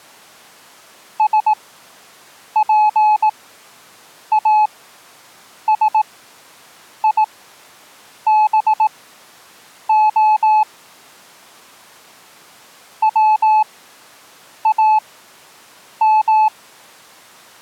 Morse code (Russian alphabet), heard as a keyed tone, machine-sent, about 18 wpm, spaced as for 7 wpm, 860 Hz. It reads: СПАСИБО ВАМ